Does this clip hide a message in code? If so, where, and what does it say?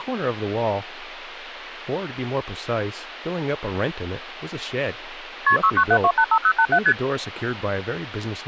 Yes: multi-frequency trunk signalling (R1, as on North American trunks) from 5.5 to 6.9 s, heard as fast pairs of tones, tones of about 70 ms, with speech in English. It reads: KP 697285087 ST